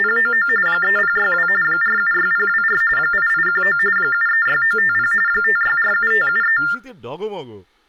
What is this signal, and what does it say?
TTY/TDD text telephone tones (45.45 baud Baudot), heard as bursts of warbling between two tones, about 400 Hz shift, 1600 Hz centre, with speech in Bangla. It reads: … 3062 476024 8819 736950 5647573